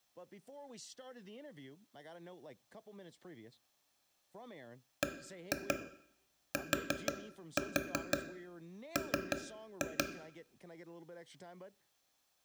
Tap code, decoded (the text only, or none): BTM